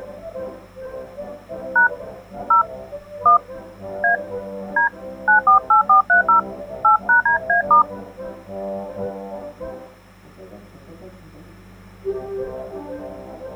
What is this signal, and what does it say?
DTMF, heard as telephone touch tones, dialled by hand, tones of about 120 ms. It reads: # 0 1 A D 948430 8#DA*